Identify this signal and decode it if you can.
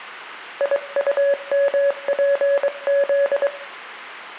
Morse code, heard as a keyed tone, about 23 wpm, 560 Hz, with room echo. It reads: IUMPZ